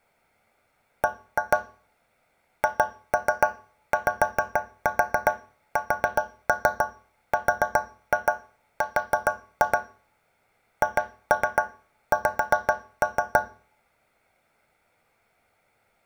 Tap code, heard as taps on a metal pipe, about 7 knocks a second, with room echo. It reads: B HYSRR HX